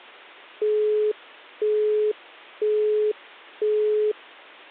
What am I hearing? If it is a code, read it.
Telephone call progress tone (single-tone plan, as in Europe, Japan and elsewhere), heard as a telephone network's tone, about 420 Hz, 0.5 s on and 0.5 s off. Busy tone.